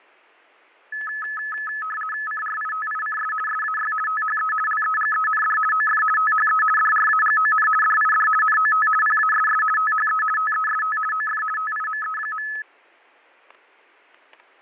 RTTY (50 baud, 450 Hz shift), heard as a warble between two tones, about 1500 Hz centre, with fading and static crashes. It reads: CRITICS SAY THE LEGEND OF THE DRAGON DID NOT PASS THE TEST OF TIME.